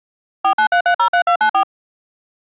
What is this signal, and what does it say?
DTMF, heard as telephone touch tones, dialled by machine, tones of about 90 ms. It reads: 493303294